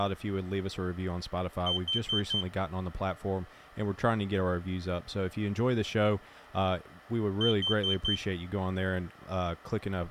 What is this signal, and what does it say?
Alarm pattern, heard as an alarm's beeps, played twice, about 3100 Hz, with speech in English. Temporal four. Carbon monoxide.